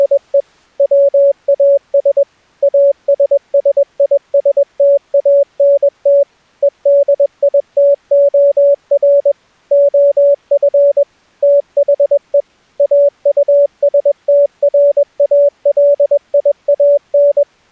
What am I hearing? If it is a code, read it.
Morse code, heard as a keyed tone, machine-sent, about 21 wpm, 570 Hz. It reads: … WAS ASSISTANT EDITOR OF THE AUSTRALIAN